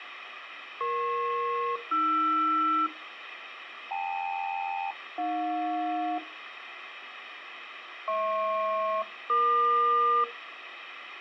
Aircraft SELCAL, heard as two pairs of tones, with radio hiss. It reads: EP-AR KL-AJ HP-EQ